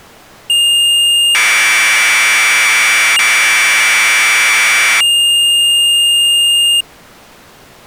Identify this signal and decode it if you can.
Commodore tape loading (standard loader), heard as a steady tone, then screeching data.